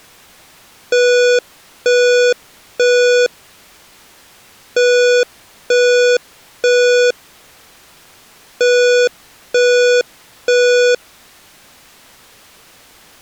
Alarm pattern, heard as an alarm's beeps, played three times, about 490 Hz. Temporal three. Smoke or fire, evacuate.